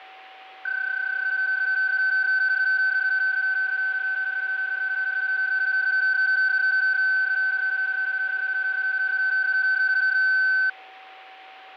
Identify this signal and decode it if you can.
PSK31 (31.25 baud), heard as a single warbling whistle, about 1550 Hz, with a steady whistle near 760 Hz.